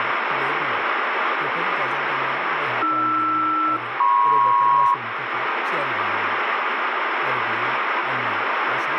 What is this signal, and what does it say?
Aircraft SELCAL, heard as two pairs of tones, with radio static and speech in Bodo. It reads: AR-MP